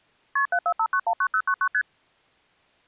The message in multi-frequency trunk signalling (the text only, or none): KP 745919099 ST